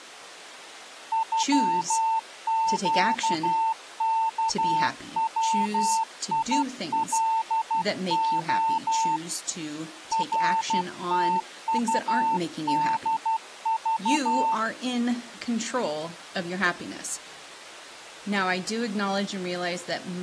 Morse code (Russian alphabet), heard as a keyed tone, hand-sent with a paddle, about 12 wpm, 900 Hz, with speech in English. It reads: ЮЩКВИЛО РТУДЖ